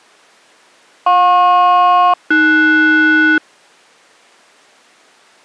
Aircraft SELCAL, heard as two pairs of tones. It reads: JP-AS